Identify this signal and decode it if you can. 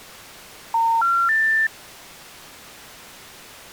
Telephone call progress tone (North American plan), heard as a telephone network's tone, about 910, 1370, 1800 Hz. Special information tone.